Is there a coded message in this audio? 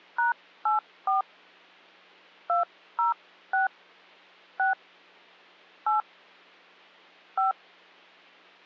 Yes: DTMF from 0.2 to 7.5 s, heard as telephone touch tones, dialled by hand, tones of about 140 ms. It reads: #84 206 6 8 5